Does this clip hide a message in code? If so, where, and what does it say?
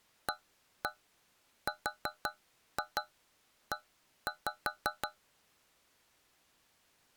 Yes: tap code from 0.3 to 5.2 s, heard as taps on a metal pipe, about 5 knocks a second. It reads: ARE